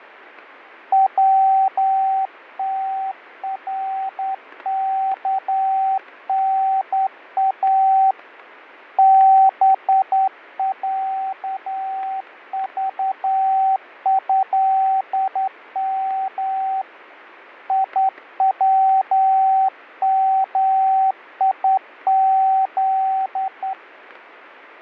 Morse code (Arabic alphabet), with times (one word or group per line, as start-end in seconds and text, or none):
0.9-8.1 وتركنا
9.0-16.8 بعضهم
17.7-23.7 يوميذ